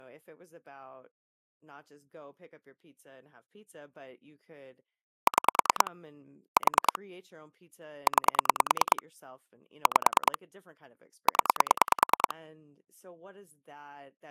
Pulse dialling, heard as clicks on a phone line, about 9 pulses a second, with speech in English. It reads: 6 4 9 5 0